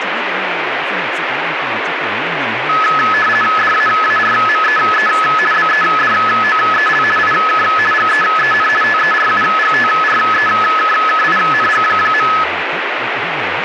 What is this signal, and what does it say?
RTTY (50 baud, 450 Hz shift), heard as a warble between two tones, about 1500 Hz centre, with radio static and speech in Vietnamese. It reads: DAARMEE BEDOEL IK GEEN TERUGTREKKING.